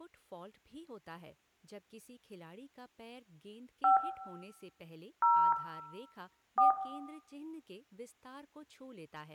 DTMF, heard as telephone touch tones, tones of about 220 ms, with room echo and speech in Hindi. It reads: 5 0 4